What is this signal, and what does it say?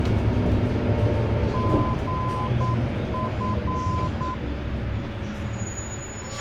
Morse code, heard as a keyed tone, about 9 wpm, 1020 Hz, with radio hiss, a squelch burst at the end and the noise inside a bus. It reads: GF